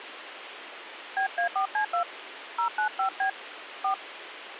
DTMF, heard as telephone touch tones, dialled by hand, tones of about 100 ms, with phone line noise. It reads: BA4C2 095B 4